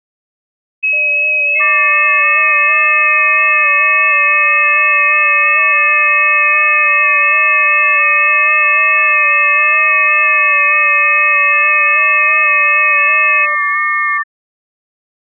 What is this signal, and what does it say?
FT8 (several signals at once), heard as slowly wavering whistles, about 6.25 baud.